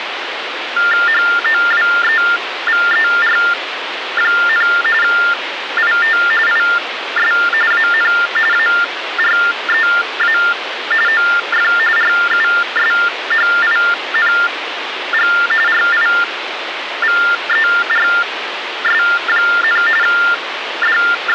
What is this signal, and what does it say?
TTY/TDD text telephone tones (45.45 baud Baudot), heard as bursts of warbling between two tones, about 400 Hz shift, 1600 Hz centre, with phone line noise. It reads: HOWEVER, IT IS AN AREA OF RUSHING RIVERS, …